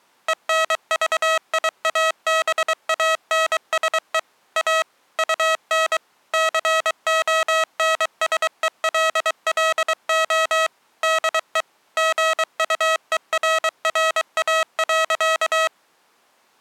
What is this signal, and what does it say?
Morse code, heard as electronic beeps, machine-sent, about 23 wpm, 640 Hz. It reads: ENVIABANSE A UN CONSELLO DE GUERRA.